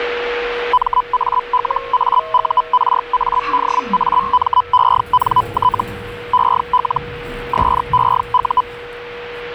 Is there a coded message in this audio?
Yes: Hellschreiber (Feld-Hell, 122.5 baud) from 0.7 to 8.6 s, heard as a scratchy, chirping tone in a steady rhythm, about 1000 Hz, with radio static, a steady whistle near 480 Hz and the noise inside a lift. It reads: MALAURADAMENT EL SEU